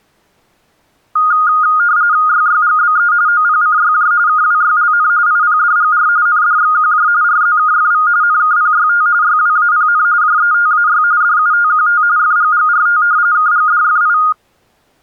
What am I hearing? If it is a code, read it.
RTTY (45.45 baud, 170 Hz shift), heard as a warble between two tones, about 1330 Hz centre. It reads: YYGBE OPCYJ KWYLN IPDGR NDXQJ RZKFV NKPYT YWAPN JETAY DUTQT FGGRT KGDFI